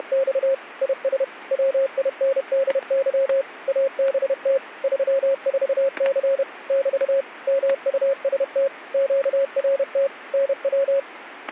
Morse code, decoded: … IS WINDY ABT 34C <BT> MUST QRT NW

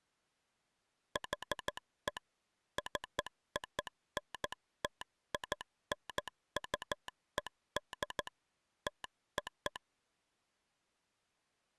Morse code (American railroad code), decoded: HE CONTINUED TO

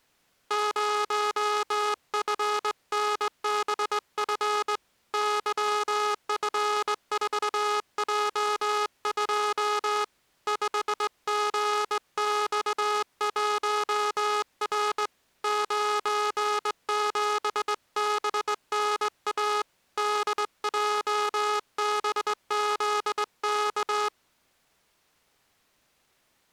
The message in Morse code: 0FNBF YF4J2 5GX1R 97BNA DJBZK

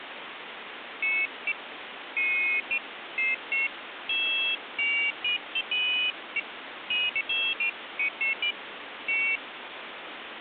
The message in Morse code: none

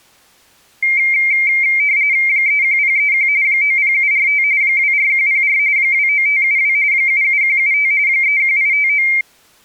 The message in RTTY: 31031 90745 24104 29572 77175 31859

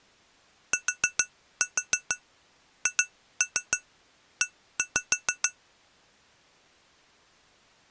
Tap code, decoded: THE

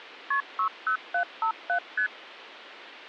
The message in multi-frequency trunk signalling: KP 60757 ST

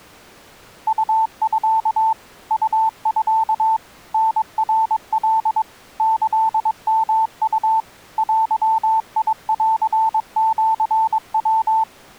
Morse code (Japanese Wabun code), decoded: ウミ ウミ タナカ キヨウ デンシヤ

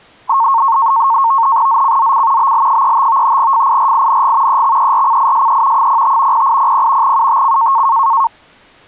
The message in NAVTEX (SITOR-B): ZCZC BL35 FIRING EXERCISE 05 0800 UTC

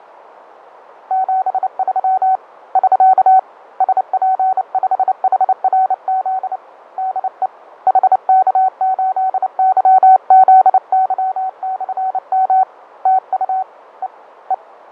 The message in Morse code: 73 <SK> SP5HRZ DE HK8YZY/M TU E E

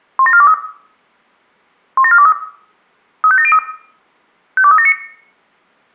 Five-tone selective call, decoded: 17423 17423 35703 52379

